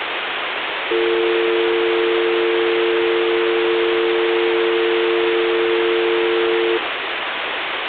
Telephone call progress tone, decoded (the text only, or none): dial tone